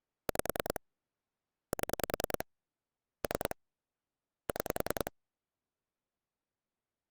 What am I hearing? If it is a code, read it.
Pulse dialling, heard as clicks on a phone line, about 10 pulses a second. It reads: 5 7 3 6